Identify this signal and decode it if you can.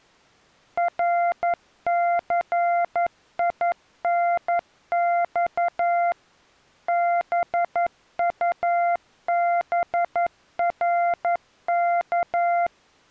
Morse code, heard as a keyed tone, machine-sent, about 11 wpm, 690 Hz. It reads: RCINX BUBRK